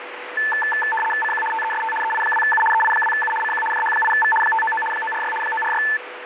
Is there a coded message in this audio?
Yes: RTTY (75 baud, 850 Hz shift) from 0.4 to 6.0 s, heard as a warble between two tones, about 1320 Hz centre, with radio static. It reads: CQ TEST EI2U EI2U CQ JH8V 599 946 946